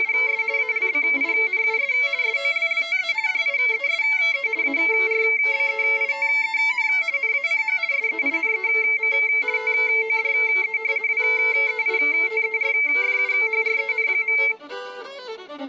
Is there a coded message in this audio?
Yes: RTTY (50 baud, 170 Hz shift) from 0.0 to 14.5 s, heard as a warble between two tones, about 2200 Hz centre. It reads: … ALBINUS SOLLTE DIESE ARBEITEN NACH SEINEM TODE WEITERFUHREN.